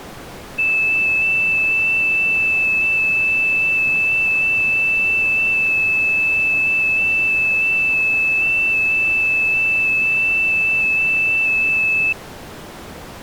FT8 (one signal), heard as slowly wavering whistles, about 6.25 baud.